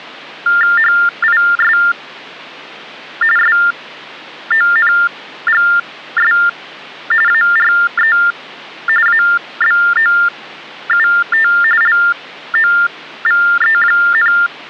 TTY/TDD text telephone tones (45.45 baud Baudot), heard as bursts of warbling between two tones, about 400 Hz shift, 1600 Hz centre. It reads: HIS SONGS ARE ABOUT LOVE,